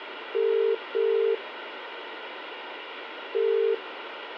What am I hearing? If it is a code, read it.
Telephone call progress tone (as in the UK, Ireland, Australia and similar networks), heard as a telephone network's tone, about 400, 450 Hz, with phone line noise. Ringback tone.